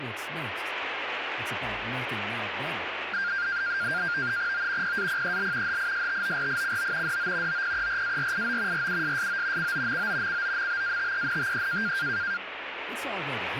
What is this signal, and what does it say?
NAVTEX (SITOR-B), 100 baud, 170 Hz shift, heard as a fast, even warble, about 1500 Hz centre, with radio static. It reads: O PAPEL HISTORICO DO OPERARIO RUSSO COMO COMBATENTE